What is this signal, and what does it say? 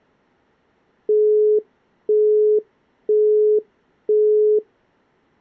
Telephone call progress tone (single-tone plan, as in Europe, Japan and elsewhere), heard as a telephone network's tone, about 420 Hz, 0.5 s on and 0.5 s off. Busy tone.